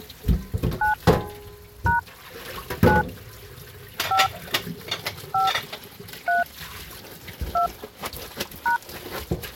DTMF, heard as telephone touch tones, dialled by hand, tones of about 130 ms, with kitchen noise. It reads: 9 # 9 5 5 3 2 #